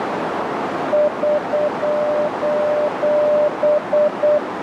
Morse code, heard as a keyed tone, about 8 wpm, 600 Hz, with heavy radio static and a narrow filter. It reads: <SOS>